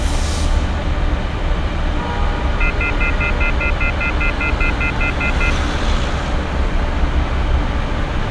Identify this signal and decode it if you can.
Telephone call progress tone (North American plan), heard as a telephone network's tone, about 1400, 2050, 2450, 2600 Hz, 0.1 s on and 0.1 s off, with street noise. Off-hook warning tone.